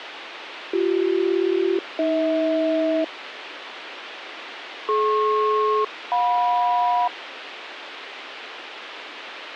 Aircraft SELCAL, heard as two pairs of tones, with radio hiss. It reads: BC-AH DP-JM